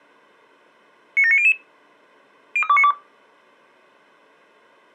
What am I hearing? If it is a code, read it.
Five-tone selective call (ZVEI), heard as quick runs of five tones, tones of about 70 ms. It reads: 97900 03292